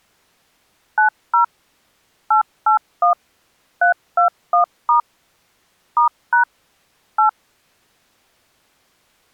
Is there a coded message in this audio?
Yes: DTMF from 1.0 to 7.3 s, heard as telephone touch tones, dialled by machine, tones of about 110 ms. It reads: 90 881 321* *# 8